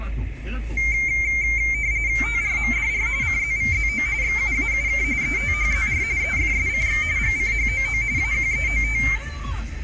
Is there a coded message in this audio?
Yes: RTTY (45.45 baud, 170 Hz shift) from 0.8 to 9.2 s, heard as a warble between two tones, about 2200 Hz centre, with room echo and the noise inside a car. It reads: TRMDR CZVZO XUAUK ETHZR EFSCX GCHOO AQEOT